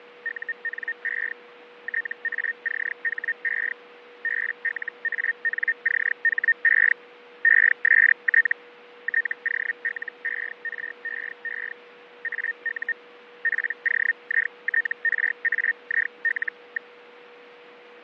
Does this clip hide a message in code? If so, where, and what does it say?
Yes: Hellschreiber (Feld-Hell, 122.5 baud) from 0.2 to 16.9 s, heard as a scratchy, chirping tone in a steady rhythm, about 1850 Hz, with radio static, fading and a steady whistle near 480 Hz. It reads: UNE TACHE BLANCHE EST TOLEREE AU POITRAIL.